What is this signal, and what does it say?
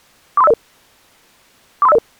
Five-tone selective call (EIA), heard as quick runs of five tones, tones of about 30 ms. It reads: 43500 43500